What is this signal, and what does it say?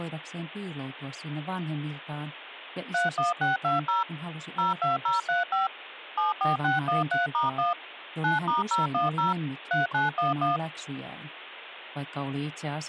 DTMF, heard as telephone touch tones, dialled by machine, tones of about 150 ms. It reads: 31620 02035 74613*1 9*010 3911